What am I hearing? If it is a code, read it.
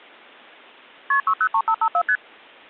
Multi-frequency trunk signalling (R1, as on North American trunks), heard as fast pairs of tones, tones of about 70 ms. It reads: KP 603554 ST